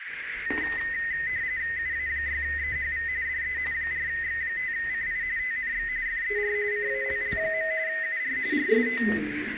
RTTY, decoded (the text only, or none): UA6EHV DE 4X5CI TNX FER CALL. UR RST